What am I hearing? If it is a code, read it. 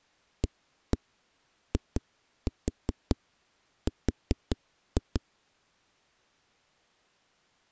Tap code, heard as knocks on a wall, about 5 knocks a second. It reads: AIR